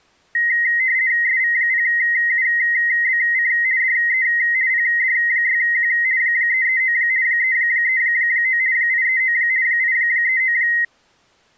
RTTY (50 baud, 170 Hz shift), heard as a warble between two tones, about 1950 Hz centre. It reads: SV0UBC DE PD6Q 339 339 839 839